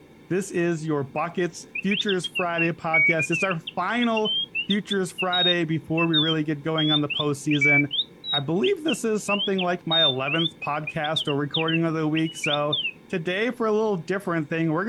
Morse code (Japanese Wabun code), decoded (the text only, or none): none